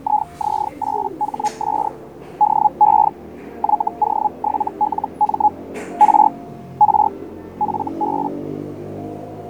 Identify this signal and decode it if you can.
Hellschreiber (Feld-Hell, 122.5 baud), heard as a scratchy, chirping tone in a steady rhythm, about 840 Hz, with fading and the noise of a crowd indoors. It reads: IZ8HS DE YO7LM R R FB